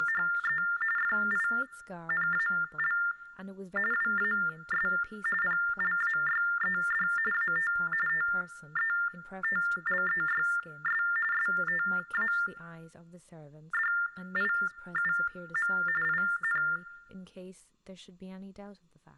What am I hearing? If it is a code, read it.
TTY/TDD text telephone tones (45.45 baud Baudot), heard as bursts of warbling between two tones, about 400 Hz shift, 1600 Hz centre, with room echo and speech in English. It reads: … FINAL WAS PLAYED AT TETLEYS STADIUM IN